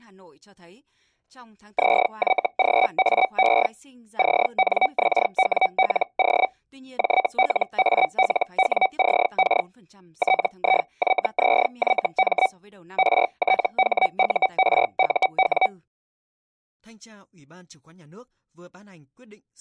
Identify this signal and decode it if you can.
Hellschreiber (Feld-Hell, 122.5 baud), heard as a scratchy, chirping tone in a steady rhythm, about 760 Hz, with speech in Vietnamese. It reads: ZYGAE CNXWLO JLALWCK TIYZYM RTHURUW